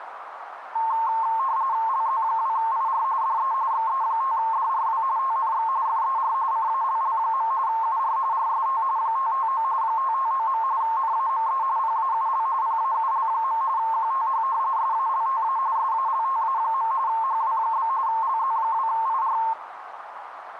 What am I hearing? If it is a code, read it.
RTTY (45.45 baud, 170 Hz shift), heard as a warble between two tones, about 980 Hz centre, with radio static and a narrow filter. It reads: LZ2IR DE XE5DRW TNX FER CALL. UR RST 559 559. NAME PAUL PAUL. QTH SALTA SALTA. HW? LZ2IR